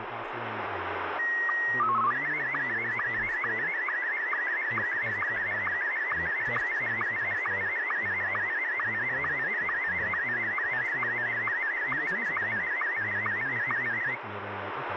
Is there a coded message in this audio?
Yes: SSTV (slow-scan television), Martin M1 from 1.2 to 14.2 s, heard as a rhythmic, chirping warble, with radio static and speech in English.